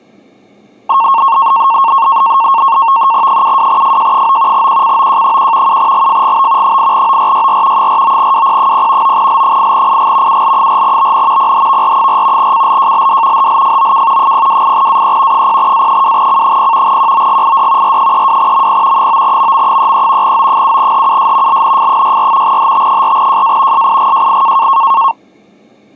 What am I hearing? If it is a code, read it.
NAVTEX (SITOR-B), 100 baud, 170 Hz shift, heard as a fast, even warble, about 1000 Hz centre. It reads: 72FJ9 QCOJ1 7GFGB 8ORYR 49WP0 9L8IG UL4BN PHVR4 CLJLD HLFOK 028AE 0A2C0 QOGID R32MP 9MM33 O7HUS LNF64 HT4JA SIGJI